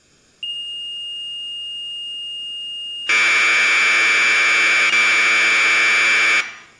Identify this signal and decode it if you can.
Commodore tape loading (standard loader), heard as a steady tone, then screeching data, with room echo.